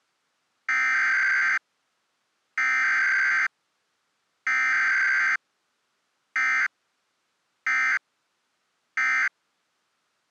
Emergency Alert System (SAME) tones (header bursts, then end-of-message bursts), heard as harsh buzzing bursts, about 520.83 baud.